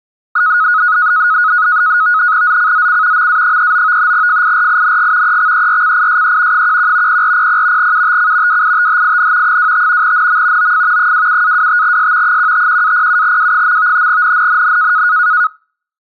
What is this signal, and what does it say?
NAVTEX (SITOR-B), 100 baud, 170 Hz shift, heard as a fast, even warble, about 1360 Hz centre. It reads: ZCZC MA39 FIRING EXERCISE 11 0400 UTC WITHIN 25 NM OF 27-25S 151-07W. NNNN